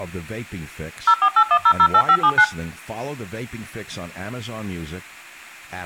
DTMF, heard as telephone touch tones, dialled by machine, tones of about 70 ms, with room echo and speech in English. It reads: 0481008579